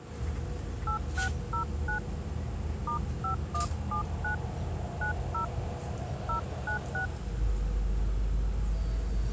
DTMF, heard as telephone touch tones, dialled by hand, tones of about 110 ms, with the noise inside a bus. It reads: 8609 *5179 90 096